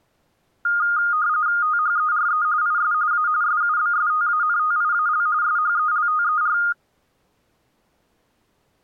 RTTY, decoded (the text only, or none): THERE IS A SUBSTANTIAL SHELTER